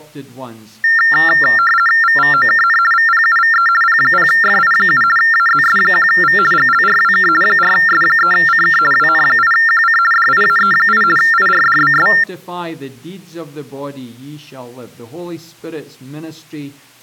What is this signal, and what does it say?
RTTY (50 baud, 450 Hz shift), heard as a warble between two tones, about 1600 Hz centre. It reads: VVOKN VPUVE P0FI7 AZS1V GLRWK 4S3CK WN8QC DIAE8 IRDBS